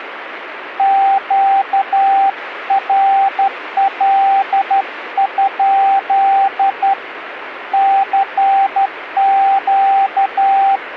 Morse code, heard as a keyed tone, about 12 wpm, 780 Hz, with radio static. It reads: QRL? CQ